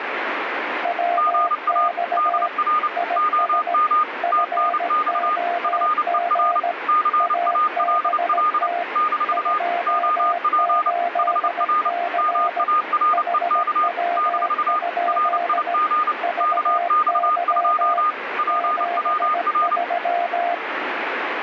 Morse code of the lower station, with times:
0.8-2.5 WX
3.0-3.7 IS
4.2-6.7 FOG
7.2-8.8 ABT
9.3-12.6 28C
13.1-15.7 HW?
16.2-18.0 VY
18.5-20.5 73

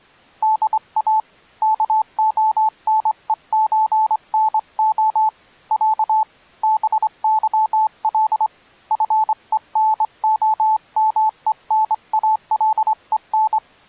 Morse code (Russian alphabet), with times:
0.4-1.2 ДА
1.6-5.3 КОНЕЧНО
5.7-6.2 Я
6.6-8.5 БЫЛ
8.9-13.6 ФЕНОМЕНАЛЕН

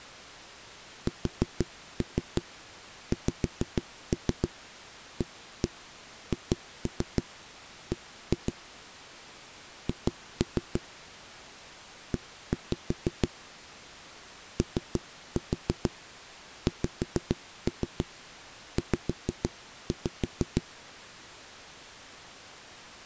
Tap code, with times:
1.1-8.5 SXAHB
9.9-10.8 H
12.1-13.3 E
14.6-20.6 OXZ

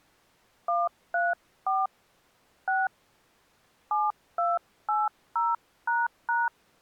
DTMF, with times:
0.7-1.9 134
2.7-2.9 6
3.9-6.5 7280##

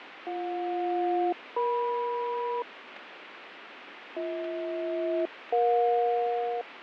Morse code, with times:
none

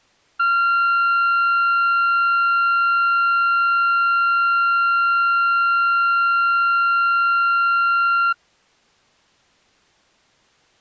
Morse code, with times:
none

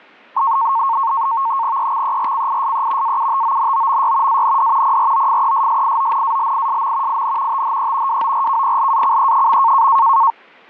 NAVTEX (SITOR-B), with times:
1.8-3.2 EXERCISE
3.0-4.4 AUTONOMY
4.3-5.0 AND
4.8-7.2 PROFESSIONALISM
7.1-7.6 IN
7.5-8.2 THE
8.1-9.9 WORKPLACE.

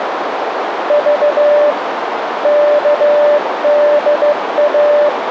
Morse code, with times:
0.9-1.7 V
2.4-5.1 KDA

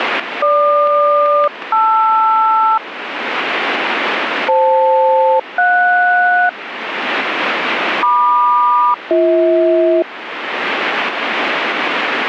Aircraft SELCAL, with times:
0.4-2.8 GQ-LR
4.5-6.5 FL-JS
8.0-10.0 MQ-BH

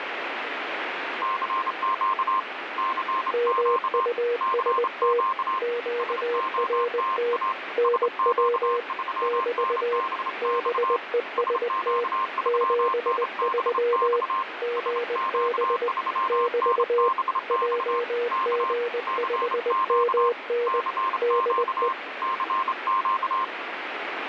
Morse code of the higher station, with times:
1.2-2.4 CQ
2.8-4.1 CQ
4.4-5.6 CQ
6.0-7.5 SOTA
7.8-11.0 SQ3NBX
11.4-14.4 SQ3NBX
14.8-18.0 SQ3NBX
18.3-18.7 K
19.1-20.3 CQ
20.7-21.9 CQ
22.2-23.4 CQ

